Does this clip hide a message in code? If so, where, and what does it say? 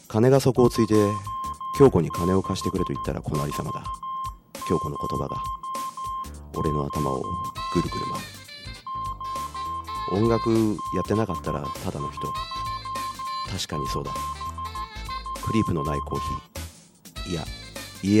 Yes: Morse code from 0.5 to 16.4 s, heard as a keyed tone, hand-sent with a paddle, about 14 wpm, 1060 Hz, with room echo. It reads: 26400 06172